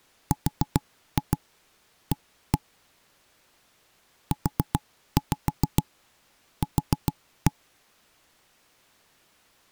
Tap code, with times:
0.3-2.6 RA
4.3-7.5 UQ

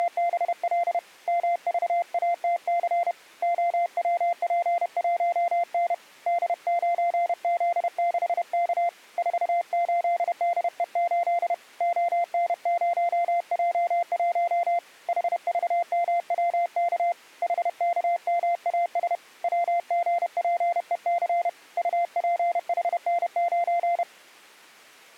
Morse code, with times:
0.0-1.0 …
1.3-3.1 MVATC
3.4-5.9 OWP1N
6.3-8.9 D9Z6K
9.2-11.5 48DE8
11.8-14.8 ON0J1
15.1-17.1 HVMWK
17.4-19.2 HKMAS
19.4-21.5 WGPEC
21.8-24.0 UPHN9

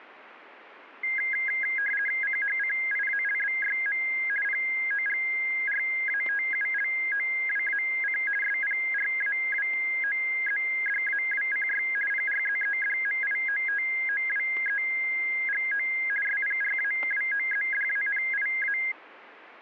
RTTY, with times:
2.2-4.0 CHCIALBYM
4.4-8.2 POGRATULOWAC
8.4-11.8 SPRAWOZDAWCY
12.1-15.9 PRZEDMIOTOWEGO
16.2-18.8 SPRAWOZDANIA

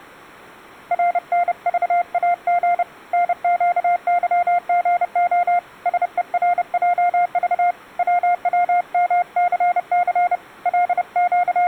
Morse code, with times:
0.9-2.8 RNVAG
3.1-5.6 NQYGO
5.9-7.7 SERJV
8.0-10.4 WWMCC
10.7-11.7 …

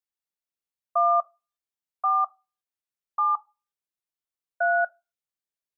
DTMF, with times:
1.0-1.2 1
2.0-2.2 4
3.2-3.4 7
4.6-4.8 3

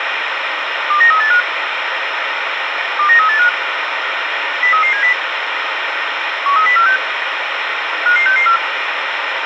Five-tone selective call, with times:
0.9-1.4 29385
3.0-3.5 29385
4.6-5.1 03370
6.5-7.0 13046
8.1-8.6 55664

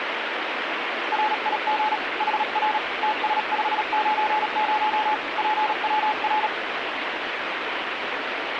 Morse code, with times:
1.1-2.0 RIG
2.2-2.8 HR
3.0-5.1 TS590
5.4-6.5 PWR

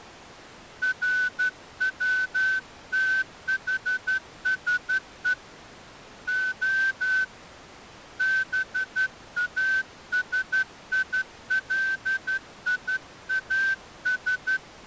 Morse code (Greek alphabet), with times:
0.8-5.3 ΡΩΤΗΣΕ
6.3-7.2 Ο
8.2-14.6 ΒΑΣΙΛΙΑΣ

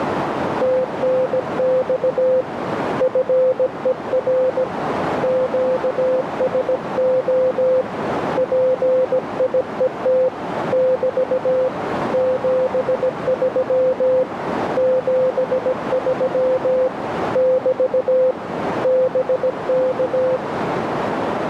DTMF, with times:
none

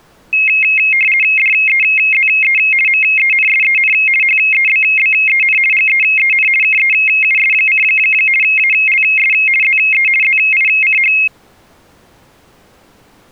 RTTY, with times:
1.4-2.6 DEZE
2.9-3.9 MENSEN
4.2-5.6 HEBBEN
5.7-6.5 GEEN
6.6-7.8 KEUS:
8.4-9.3 ALS
9.6-10.1 ZE
10.2-11.1 ZICH

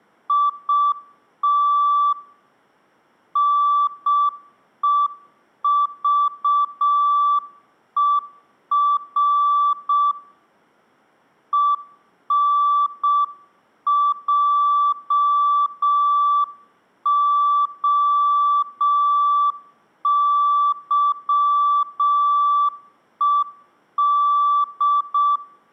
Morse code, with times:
0.3-2.1 IT
3.4-10.1 NEVER
11.5-25.4 ENJOYED

